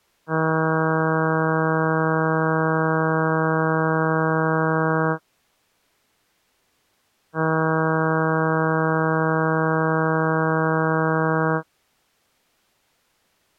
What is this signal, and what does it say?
Ship horn signal, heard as a ship's horn, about 160 Hz. 2 long. At sea: a vessel under power that has stopped in fog.